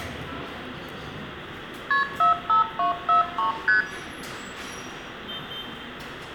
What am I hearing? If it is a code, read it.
Multi-frequency trunk signalling (R1, as on North American trunks), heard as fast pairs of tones, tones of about 130 ms, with room echo and the noise of a subway station. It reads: KP 45243 ST